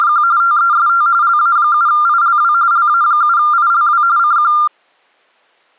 RTTY (45.45 baud, 170 Hz shift), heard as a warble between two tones, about 1290 Hz centre. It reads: … TEST LA7ILW LA7ILW CQ